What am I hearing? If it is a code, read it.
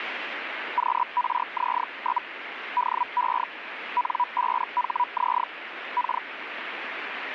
Hellschreiber (Feld-Hell, 122.5 baud), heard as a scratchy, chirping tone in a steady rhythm, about 980 Hz, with radio static. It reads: QRZ? DE N5HZ K